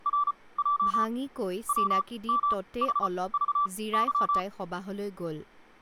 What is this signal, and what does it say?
Morse code (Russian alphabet), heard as a keyed tone, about 34 wpm, spaced as for 21 wpm, 1160 Hz, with speech in Assamese. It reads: РЙ ВМХЖЫ